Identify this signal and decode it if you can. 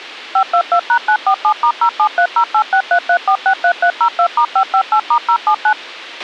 DTMF, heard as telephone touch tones, dialled by machine, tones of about 80 ms, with a squelch burst at the end. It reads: 522#947*07308633463302*558*079